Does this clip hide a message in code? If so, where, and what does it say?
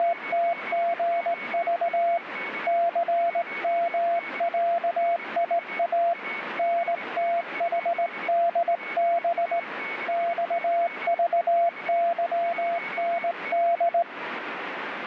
Yes: Morse code (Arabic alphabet) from 0.0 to 14.1 s, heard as a keyed tone, hand-sent with a straight key, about 18 wpm, 680 Hz, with radio static and a weaker station near 2220 Hz. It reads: … ثمعيا نتحدب صضظند